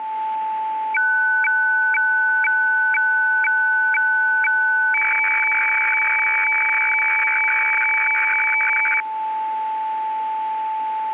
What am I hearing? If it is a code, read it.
Weather fax (radiofax), 120 lines a minute, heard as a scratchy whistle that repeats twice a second, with a steady whistle near 880 Hz.